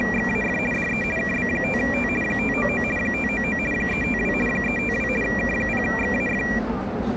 RTTY (50 baud, 450 Hz shift), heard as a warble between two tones, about 2150 Hz centre, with the noise of a subway station. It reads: … DE KB5T 599 599 352 352 K0XAF